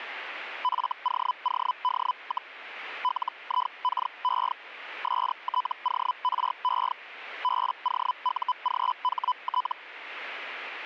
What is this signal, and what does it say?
Hellschreiber (Feld-Hell, 122.5 baud), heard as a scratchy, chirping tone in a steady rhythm, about 1000 Hz. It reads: FOOD, LIKE STORE BOUGHT